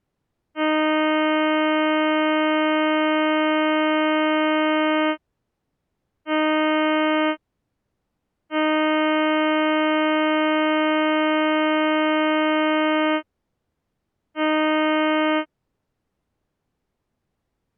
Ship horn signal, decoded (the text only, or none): 1 long, 1 short, 1 long, 1 short